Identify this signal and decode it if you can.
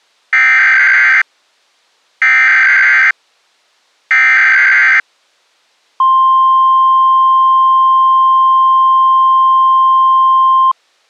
Emergency Alert System (SAME) tones (header bursts, then the 1050 Hz attention tone), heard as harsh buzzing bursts, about 520.83 baud.